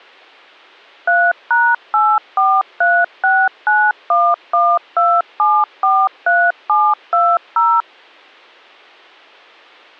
DTMF, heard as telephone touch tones, dialled by machine, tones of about 240 ms. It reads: 3#84369112743720